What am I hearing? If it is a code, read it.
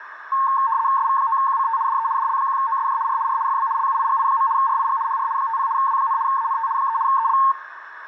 RTTY (75 baud, 170 Hz shift), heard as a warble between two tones, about 990 Hz centre, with radio static and a narrow filter. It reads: SV9QCT DE DL1OSJ R R FB LUIGI. RIG HR 50 W, ANT 3 EL